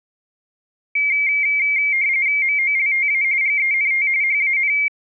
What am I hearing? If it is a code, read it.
RTTY (45.45 baud, 170 Hz shift), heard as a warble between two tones, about 2200 Hz centre. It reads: MOLTA GENT HAN